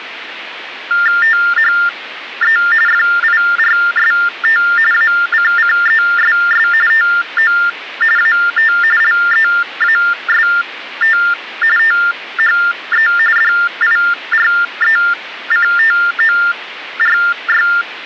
TTY/TDD text telephone tones (45.45 baud Baudot), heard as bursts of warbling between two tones, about 400 Hz shift, 1600 Hz centre, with phone line noise. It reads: THE FIRST ACCESS TO AT LEAST THE DIRECTORY